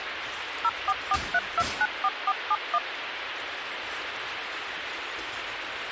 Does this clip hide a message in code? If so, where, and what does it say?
Yes: DTMF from 0.6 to 2.8 s, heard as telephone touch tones, dialled by machine, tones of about 50 ms, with phone line noise and kitchen noise. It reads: 0443294471